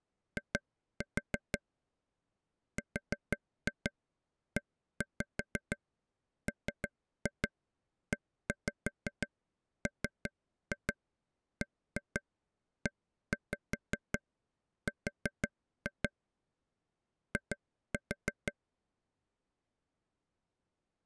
Tap code, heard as taps on a table, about 5 knocks a second. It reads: I REMEMBER I